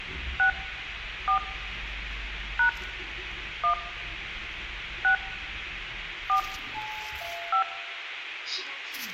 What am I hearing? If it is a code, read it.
DTMF, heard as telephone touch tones, dialled by hand, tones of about 100 ms, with radio hiss, room echo and the noise inside a lift. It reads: 6 4 # 1 6 4 5